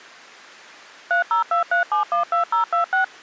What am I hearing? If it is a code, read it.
DTMF, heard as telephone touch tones, dialled by machine, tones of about 120 ms. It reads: 3023712026